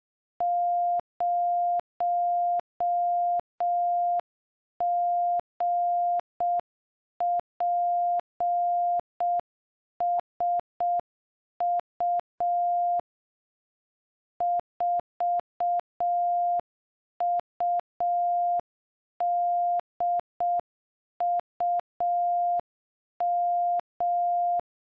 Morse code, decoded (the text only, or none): 0GPSU 4UDUM